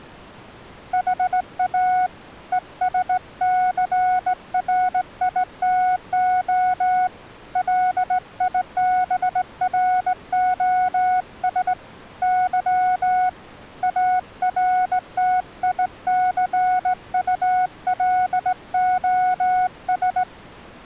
Morse code, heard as a keyed tone, hand-sent with a straight key, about 18 wpm, 740 Hz. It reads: HA ESCRITO LIBROS Y ARTICULOS